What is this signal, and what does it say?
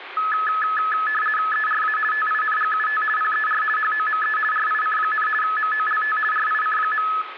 RTTY (50 baud, 450 Hz shift), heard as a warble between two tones, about 1500 Hz centre, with radio static and room echo. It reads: ERA TINGUT PER HOME RIC, MOLT RIC.